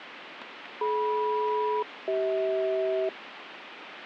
Aircraft SELCAL, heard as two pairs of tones, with radio static. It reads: DM-CH